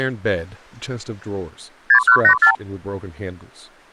Multi-frequency trunk signalling (R2, with the far end's replies), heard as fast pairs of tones, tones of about 90 ms, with speech in English. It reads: 6184